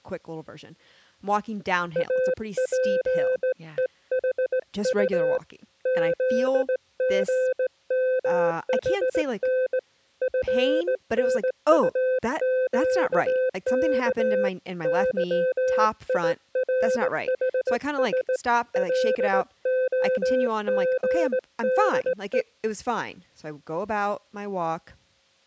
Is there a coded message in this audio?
Yes: Morse code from 1.9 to 22.5 s, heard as a keyed tone, hand-sent with a straight key, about 18 wpm, 510 Hz, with speech in English. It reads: APEHU ZGMHN FNUQK YIRHS LOGDE